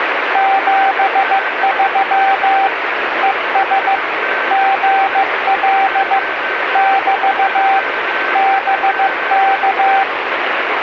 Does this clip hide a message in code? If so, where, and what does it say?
Yes: Morse code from 0.3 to 10.1 s, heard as a keyed tone, machine-sent, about 15 wpm, 780 Hz, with radio static and a weaker station near 1540 Hz. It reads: 73 ES GL <BT> BK